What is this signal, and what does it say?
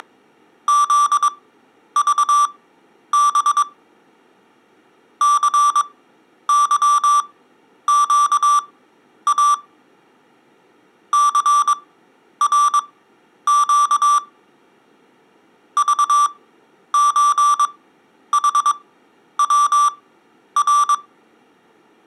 Morse code (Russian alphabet), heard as electronic beeps, machine-sent, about 22 wpm, spaced as for 10 wpm, 1170 Hz. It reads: … ЦЫЩА ЦРЩ ЖЧХВР